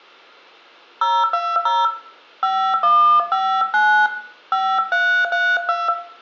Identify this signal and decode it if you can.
DTMF, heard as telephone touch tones, dialled by hand, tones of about 280 ms, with room echo. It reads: 020 5159 5332